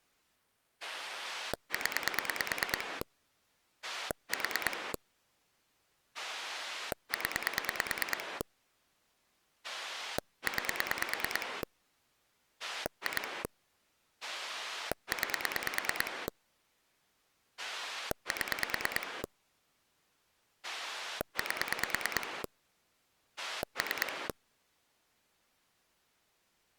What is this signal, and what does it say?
Pulse dialling, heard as a rotary dial, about 9 pulses a second. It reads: 0 4 0 9 2 9 7 8 3